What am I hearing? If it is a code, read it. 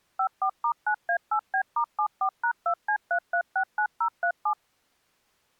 DTMF, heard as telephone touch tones, dialled by machine, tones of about 80 ms. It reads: 54*9A8B*74#2C3369037